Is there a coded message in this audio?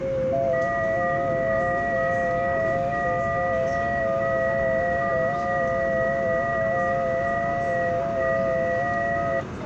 Yes: FT8 (several signals at once) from 0.0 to 9.4 s, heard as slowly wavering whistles, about 6.25 baud, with the noise inside a subway train.